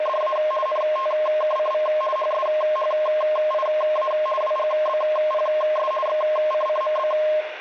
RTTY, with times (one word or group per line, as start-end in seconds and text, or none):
0.0-0.4 …
0.7-1.9 NTKCV
2.2-4.1 HSHIA
4.4-5.9 WGBPS
6.1-7.1 XCCMB